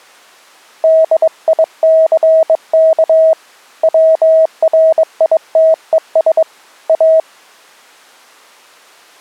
Morse code, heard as a keyed tone, hand-sent with a bug key, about 22 wpm, 640 Hz. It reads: DICK WRITES A